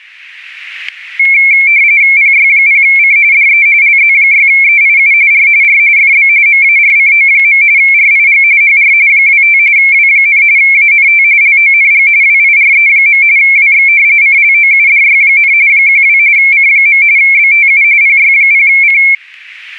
RTTY (45.45 baud, 170 Hz shift), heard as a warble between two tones, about 2250 Hz centre, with static crashes. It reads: PY0C DE LZ6EIU R R FB MARCO. RIG HR 25 W, ANT LONG WIRE. WX CLOUDY, 12 C. BTU PY0C